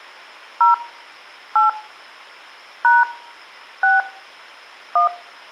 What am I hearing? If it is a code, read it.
DTMF, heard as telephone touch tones, dialled by hand, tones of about 170 ms. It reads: 0 8 # 6 1